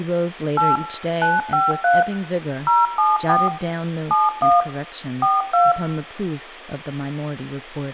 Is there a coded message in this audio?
Yes: DTMF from 0.6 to 5.7 s, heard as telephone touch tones, dialled by machine, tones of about 180 ms, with room echo and speech in English. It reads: 8 953 074 71 42